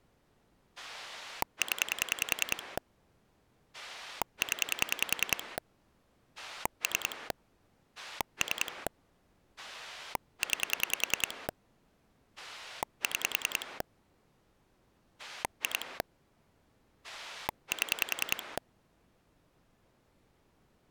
Pulse dialling, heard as a rotary dial, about 10 pulses a second. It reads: 0 0 3 3 9 6 2 7